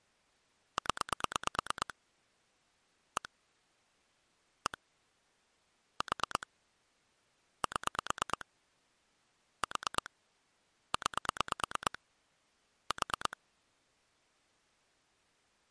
Pulse dialling, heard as clicks on a phone line, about 9 pulses a second. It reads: 0 1 1 4 7 4 9 4